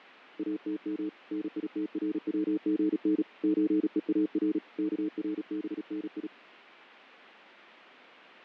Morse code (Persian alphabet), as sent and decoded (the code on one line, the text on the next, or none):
.- - -- / -. .. - .-. .-- --. -. / ---. . .- .-. / -.- .-. -... -. ..
اتم نیتروژن چهار کربنی